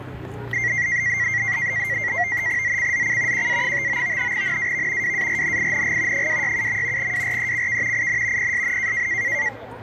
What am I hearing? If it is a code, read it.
NAVTEX (SITOR-B), 100 baud, 170 Hz shift, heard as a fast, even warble, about 2000 Hz centre, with the noise of a residential street. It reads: ZCZC QA59 NAV WARNING 267. WRECK IN PSN